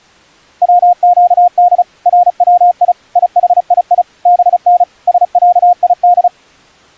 Morse code (Arabic alphabet), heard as a keyed tone, machine-sent, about 35 wpm, 710 Hz. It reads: وقد روي يحيي بن سعيد